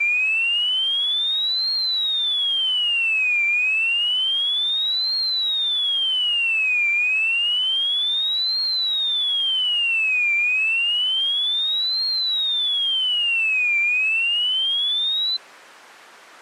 A tone that sweeps in pitch again and again. There is no code.